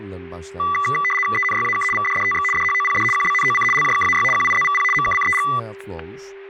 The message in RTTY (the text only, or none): ENYAK VDDTX DHOPD QBNOC LJKAY QIZVP MKCEG